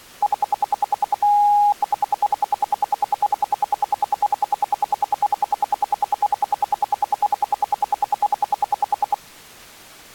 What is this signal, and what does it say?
Radio time signal (RWM, Moscow), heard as ten pulses a second.